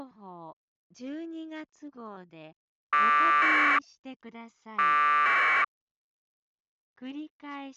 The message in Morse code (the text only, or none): none